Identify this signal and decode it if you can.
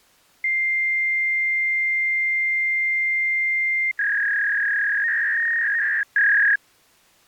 Fax machine handshake, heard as a long tone and a warble.